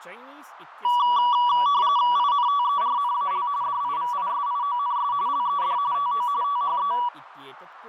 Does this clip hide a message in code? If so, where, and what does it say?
Yes: RTTY (45.45 baud, 170 Hz shift) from 0.8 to 7.1 s, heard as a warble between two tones, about 1060 Hz centre, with radio static, fading and speech in Sanskrit. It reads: INTERNAL DIVISIONS LED TO THE